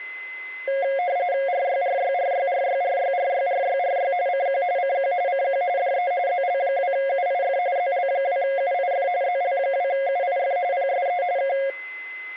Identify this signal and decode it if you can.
RTTY (45.45 baud, 170 Hz shift), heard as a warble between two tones, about 630 Hz centre, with a steady whistle near 2040 Hz. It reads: RYRYRYRYRYRYRYRY CQ CQ CQ DE ZL2UIF ZL2UIF ZL2UIF PSE K